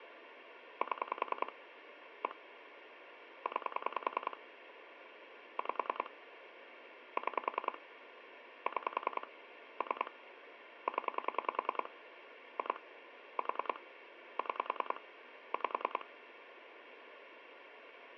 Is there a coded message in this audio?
Yes: pulse dialling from 0.8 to 16.0 s, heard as clicks on a phone line, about 10 pulses a second, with phone line noise. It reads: 7 1 9 5 6 6 3 0 2 4 6 5